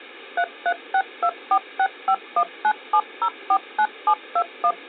DTMF, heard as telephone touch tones, dialled by machine, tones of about 70 ms. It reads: 3362465197049721